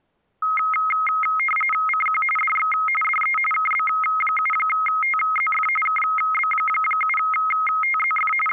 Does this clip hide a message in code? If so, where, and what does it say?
Yes: RTTY (45.45 baud, 850 Hz shift) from 0.4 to 8.5 s, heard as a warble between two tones, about 1700 Hz centre. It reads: CQ DX DE KB7TZF KB7TZF …